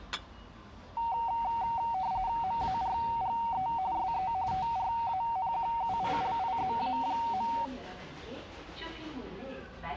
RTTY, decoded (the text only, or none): MARGE SE TRANQUILIZA.